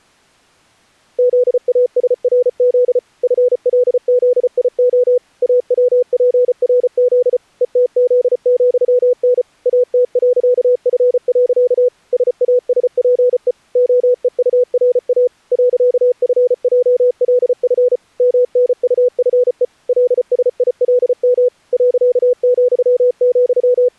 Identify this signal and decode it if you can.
Morse code, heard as a keyed tone, machine-sent, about 34 wpm, 500 Hz. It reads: ZASRZ FLZIO AWPRZ ETZ,N AT.F. SASPE OEURA .FJLF MNUFE LSILM …